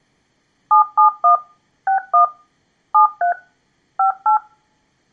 DTMF, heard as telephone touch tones, dialled by machine, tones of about 110 ms, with room echo. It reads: 771 61 73 58